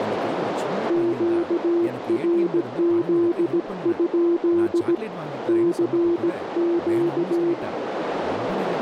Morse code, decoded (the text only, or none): QRZ? CQ